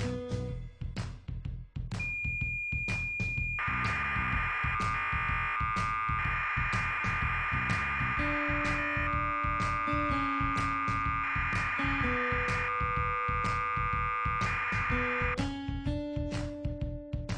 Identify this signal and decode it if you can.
Cassette data (Kansas City type), 1200 baud, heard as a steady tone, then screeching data.